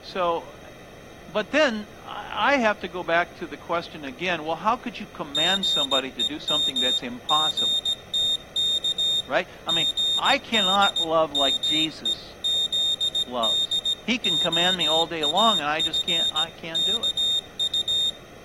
Morse code (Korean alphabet), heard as a high beeper, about 17 wpm, 3650 Hz, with room echo and speech in English. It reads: 삼성 스마트폰이